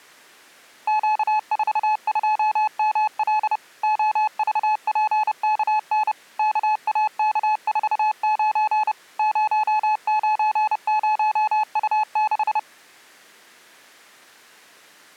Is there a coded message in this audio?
Yes: Morse code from 0.8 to 12.7 s, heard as a keyed tone, machine-sent, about 30 wpm, 860 Hz. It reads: Q42ML OVPKN KAK49 090U6